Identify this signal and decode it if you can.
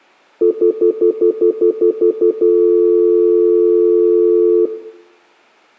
Telephone call progress tone (North American plan), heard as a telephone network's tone, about 350, 440 Hz, 0.1 s on and 0.1 s off, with room echo. Stutter dial tone.